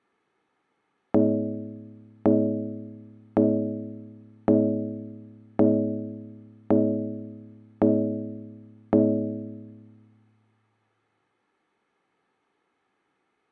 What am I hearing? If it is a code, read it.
Clock strike, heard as a bell, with room echo. 8. Eight o'clock.